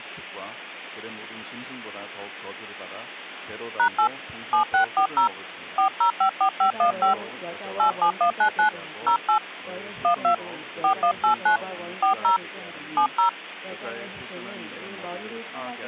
DTMF, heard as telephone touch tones, dialled by hand, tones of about 100 ms. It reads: #8 7640 4054515 87199 08 12 4189 40 70